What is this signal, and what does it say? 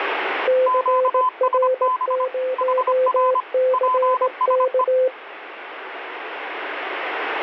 Morse code, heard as two keyed tones, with radio static. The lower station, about 18 wpm, 510 Hz: CR0CK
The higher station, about 25 wpm, 1020 Hz: QSB HR PSE